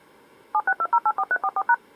DTMF, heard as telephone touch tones, dialled by machine, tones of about 50 ms. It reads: 762084344#